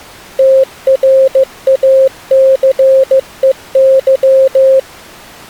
Morse code, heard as a keyed tone, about 15 wpm, 530 Hz. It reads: TRACEY